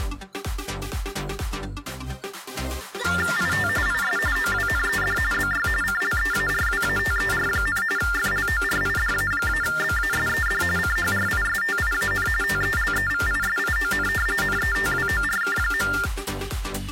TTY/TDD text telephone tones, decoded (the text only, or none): IT IS OWNED BY CLEARWATER, FLORIDA-BASED CHRISTIAN TELEVISION NETWORK.